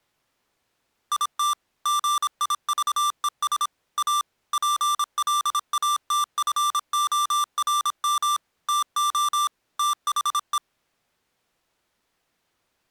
Morse code, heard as electronic beeps, machine-sent, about 26 wpm, 1180 Hz. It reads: IT GIVES A PLATFORM TO THE